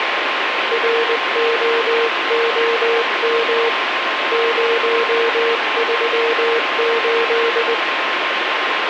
Morse code, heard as a keyed tone, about 20 wpm, 460 Hz, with radio static and a steady whistle near 1060 Hz. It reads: ROOM 038